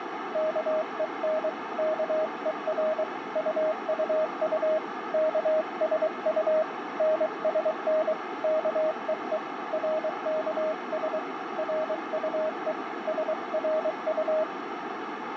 Morse code, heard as a keyed tone, hand-sent with a paddle, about 23 wpm, 630 Hz, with radio static and a narrow filter. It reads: KEN KER UUU KSU NSN KEE RKS RUE SRU